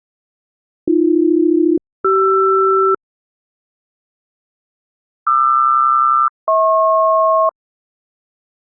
Aircraft SELCAL, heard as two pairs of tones. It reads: AB-CR QR-HP